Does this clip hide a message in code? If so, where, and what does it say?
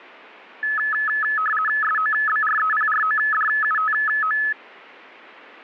Yes: RTTY (50 baud, 450 Hz shift) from 0.6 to 4.5 s, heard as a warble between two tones, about 1500 Hz centre. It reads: SOBREPRODUTO